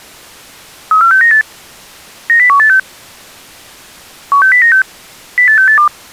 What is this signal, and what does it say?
Five-tone selective call (CCIR), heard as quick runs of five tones, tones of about 100 ms. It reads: 34698 90186 16096 08682